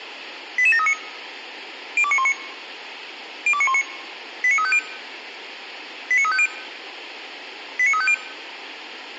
Five-tone selective call (ZVEI), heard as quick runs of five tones, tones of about 70 ms, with radio hiss. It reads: 88739 02919 02919 89350 89350 89350